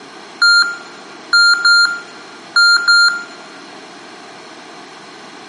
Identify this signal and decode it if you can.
Beep code, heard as beeps from a small speaker, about 1400 Hz, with room echo. 1-2-2. In Phoenix BIOS tables: DMA initialisation failure.